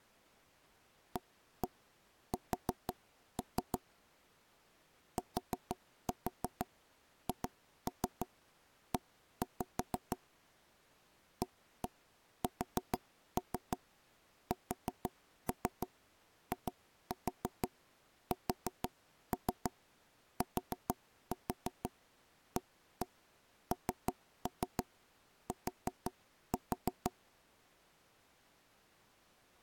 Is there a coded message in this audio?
Yes: tap code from 1.2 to 27.1 s, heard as knocks on wood, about 6 knocks a second. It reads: AS THE ASSISTANT